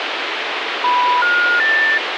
Telephone call progress tone (North American plan), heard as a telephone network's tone, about 980, 1430, 1800 Hz, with phone line noise. Special information tone.